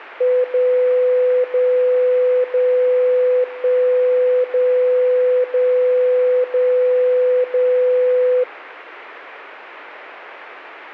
Radio time signal (DCF77), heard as a tone whose level steps once a second, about 500 Hz. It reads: 0 0 0 1 0 0 0 0